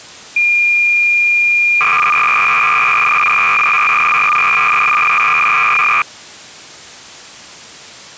Cassette data (Kansas City type), 300 baud, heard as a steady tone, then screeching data.